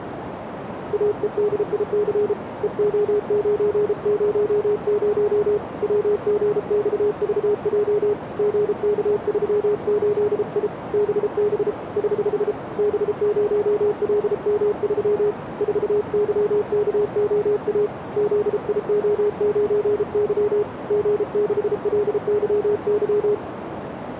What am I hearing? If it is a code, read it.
Morse code, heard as a keyed tone, hand-sent with a paddle, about 33 wpm, 420 Hz, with radio static and a narrow filter. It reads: AEDIC EO900 WGXVJ GK38I BB <HH> B0LM3 4YKOA ZIO9Y G6LYY